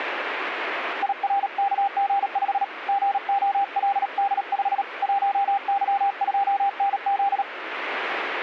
Morse code, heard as a keyed tone, hand-sent with a paddle, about 37 wpm, 800 Hz, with radio static. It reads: IRKG5 GOLD5 1Y2NZ